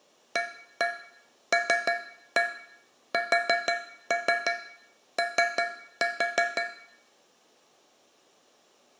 Tap code, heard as taps on a metal pipe, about 5 knocks a second, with room echo. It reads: ALSO